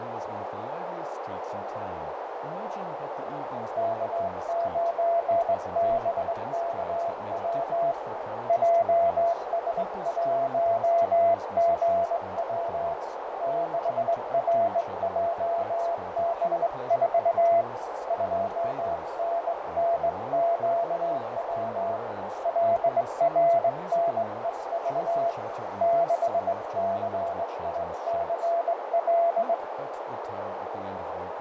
Morse code, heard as a keyed tone, hand-sent with a straight key, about 20 wpm, 680 Hz, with heavy radio static, fading and a narrow filter. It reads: K9BKW JS1GW 6RJB4 2NNQW LRNEV 6CICL